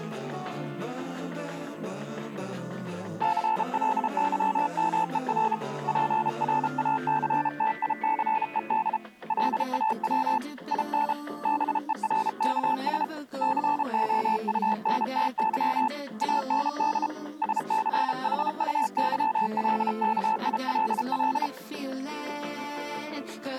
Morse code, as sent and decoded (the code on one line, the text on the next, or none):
-.-. .-.. -.-- -- . .-. / .--. .-. .- -.-. - .. -.-. . -.. / .-.. .- .-- / .. -. / -... . .-. -.- ... / -.-. --- ..- -. - -.-- / .- -. -.. / ... -.-. .... ..- -.-- .-.. -.- .. .-.. .-..
CLYMER PRACTICED LAW IN BERKS COUNTY AND SCHUYLKILL